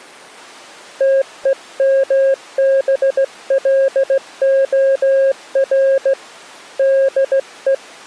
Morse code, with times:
1.0-6.1 TEMBLOR
6.8-7.7 DE

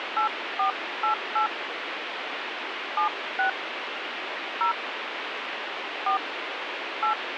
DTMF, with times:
0.2-1.5 8488
3.0-3.5 76
4.6-4.7 0
6.1-6.2 4
7.0-7.1 8

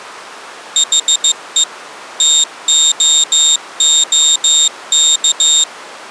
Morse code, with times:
0.8-1.6 HE
2.2-5.6 TOOK

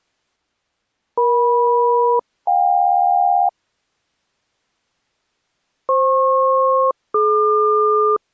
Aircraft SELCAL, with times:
1.2-3.5 EM-JK
5.9-8.2 FP-DQ

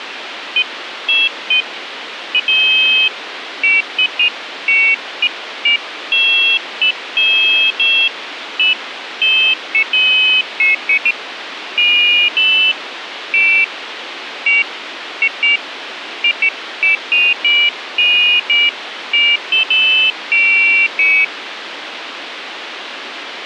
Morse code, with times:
none

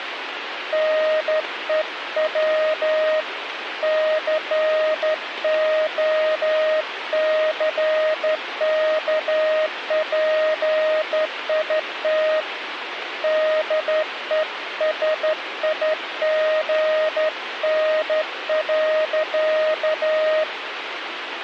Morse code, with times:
0.7-3.2 NEW
3.8-12.4 COCKPIT
13.2-20.4 DESIGN.

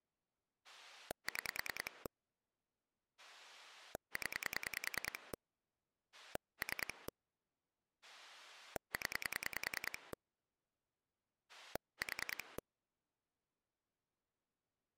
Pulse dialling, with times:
0.6-2.1 6
3.2-5.3 0
6.1-7.1 3
8.0-10.1 0
11.5-12.6 4

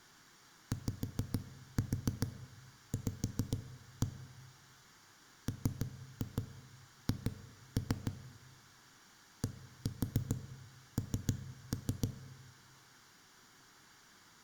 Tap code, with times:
0.7-4.1 YV
5.5-8.1 MH
9.4-12.1 DN

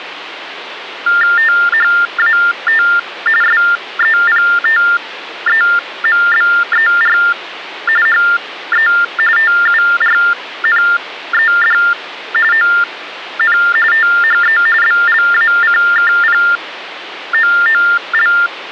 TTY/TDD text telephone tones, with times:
1.4-2.8 THAT
3.4-7.2 SEPTEMBER
8.1-8.9 HE
9.4-11.8 TURNED
12.5-13.6 ON
13.9-14.6 THE
14.8-18.3 BLACKPOOL

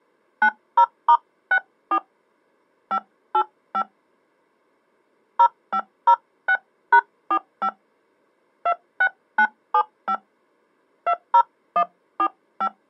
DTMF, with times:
0.4-2.0 90*64
2.9-3.8 585
5.4-7.7 0506#45
8.7-10.1 26975
11.1-12.7 20145

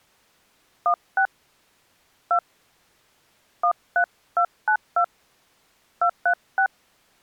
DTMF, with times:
0.9-1.3 16
2.3-2.4 2
3.6-5.0 13292
6.0-6.7 236

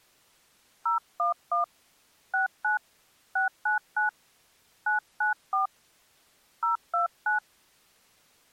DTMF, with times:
0.9-1.6 011
2.3-2.8 69
3.4-4.1 699
4.9-5.7 994
6.6-7.4 029

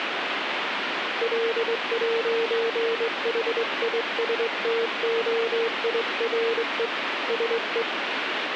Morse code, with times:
1.2-6.9 L'HISTOIRE
7.3-7.8 SE

